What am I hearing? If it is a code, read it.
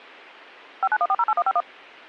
DTMF, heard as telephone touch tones, dialled by machine, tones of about 50 ms. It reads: 591408151